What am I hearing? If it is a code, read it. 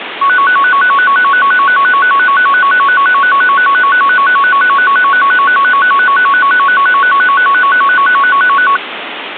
A tone that alternates evenly between two pitches, with phone line noise. There is no code.